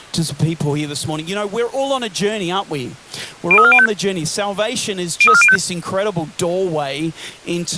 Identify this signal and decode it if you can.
Five-tone selective call (ZVEI), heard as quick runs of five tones, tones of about 70 ms. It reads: 03405 03405